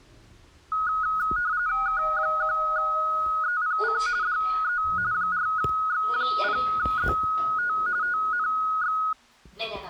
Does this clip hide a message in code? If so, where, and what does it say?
Yes: RTTY (45.45 baud, 170 Hz shift) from 0.7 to 9.1 s, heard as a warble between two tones, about 1360 Hz centre, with the noise inside a lift. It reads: K1EPC DE 4X0ZT TNX